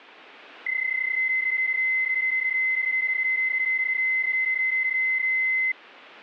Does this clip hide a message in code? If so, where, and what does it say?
Yes: PSK31 (31.25 baud) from 0.7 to 5.7 s, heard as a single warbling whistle, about 2050 Hz.